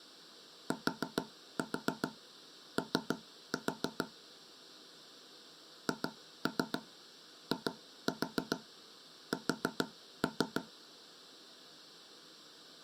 Tap code, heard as taps on a table, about 6 knocks a second. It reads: TO HIS